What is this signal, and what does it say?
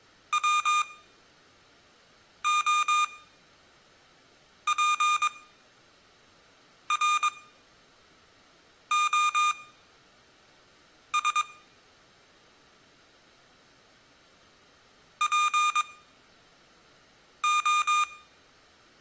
Morse code (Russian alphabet), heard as electronic beeps, machine-sent, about 22 wpm, spaced as for 5 wpm, 1220 Hz, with room echo. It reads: ВОПРОС ПО